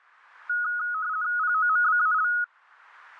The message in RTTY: POMBAL

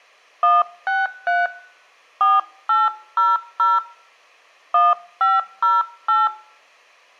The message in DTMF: 163 4800 1508

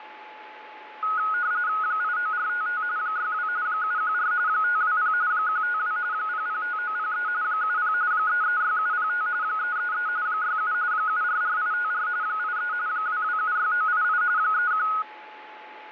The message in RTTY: 89455 62 714 520 152 005903 70 336705 333 67 744854 83 2276988 31

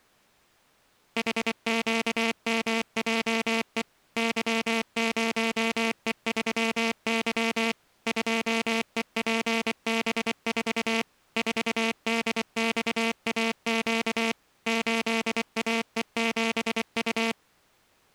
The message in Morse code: HQMJE Y0E3Y 2EPB4 4DXAQ 8AE7U

